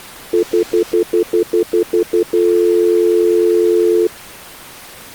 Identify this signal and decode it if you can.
Telephone call progress tone (North American plan), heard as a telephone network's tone, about 350, 440 Hz, 0.1 s on and 0.1 s off. Stutter dial tone.